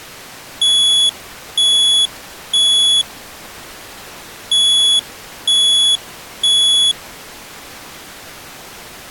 Alarm pattern, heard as an alarm's beeps, played twice, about 3400 Hz. Temporal three. Smoke or fire, evacuate.